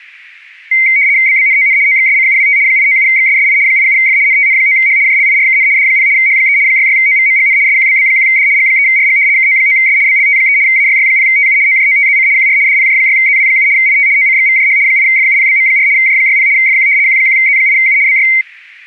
RTTY (75 baud, 170 Hz shift), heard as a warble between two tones, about 2150 Hz centre, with static crashes. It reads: BBNON OXSCUWT 897XSSI 87F NTN9H JLIRKN D0 H3 66OVMGN SQBB1D G3RG KO9S BLT3 AYY0TU OJOTZC QR DPJ6ZW7 IT OCXVJH 8FUPBM4 J60 FQ Q1Z8U BY